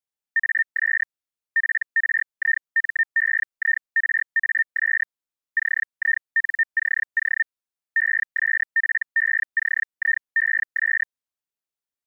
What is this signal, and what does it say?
Hellschreiber (Feld-Hell, 122.5 baud), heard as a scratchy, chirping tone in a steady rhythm, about 1800 Hz. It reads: AS PRIMEIRAS CINCO ESPECIES